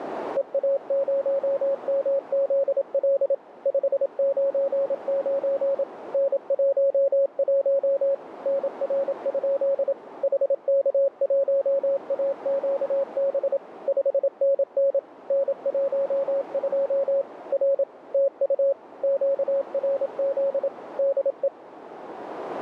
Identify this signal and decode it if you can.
Morse code, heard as a keyed tone, machine-sent, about 27 wpm, 550 Hz, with radio static and a narrow filter. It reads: EA0MZL 599 N11 NR? HK1AQB 5NN N12 R TU QRZ DE